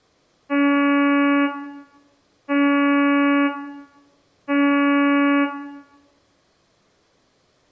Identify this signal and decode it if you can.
Ship horn signal, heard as a ship's horn, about 280 Hz, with room echo. 3 short. At sea: I am operating astern propulsion.